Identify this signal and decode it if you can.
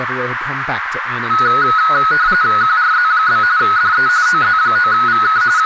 RTTY (45.45 baud, 170 Hz shift), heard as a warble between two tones, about 1370 Hz centre, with radio static, a narrow filter and speech in English. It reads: QRZ? DE OZ9VK …